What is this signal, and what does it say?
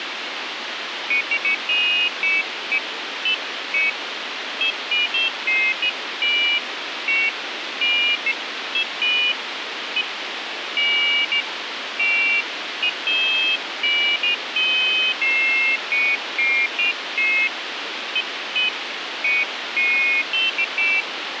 Pairs of high tones at irregular times, with radio hiss. There is no code.